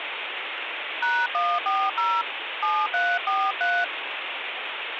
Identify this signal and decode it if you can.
DTMF, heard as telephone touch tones, dialled by hand, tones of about 240 ms, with phone line noise. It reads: #140 7343